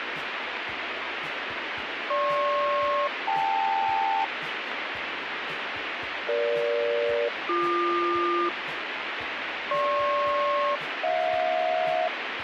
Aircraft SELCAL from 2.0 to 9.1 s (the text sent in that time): GP-KL EG-BQ